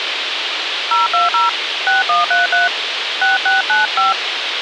DTMF, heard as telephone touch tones, dialled by hand, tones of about 150 ms, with radio hiss. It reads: 020 6133 6695